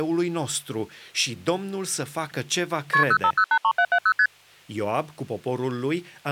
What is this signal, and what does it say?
Multi-frequency trunk signalling (R1, as on North American trunks), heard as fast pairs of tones, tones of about 70 ms, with speech in Romanian. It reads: KP 05083770 ST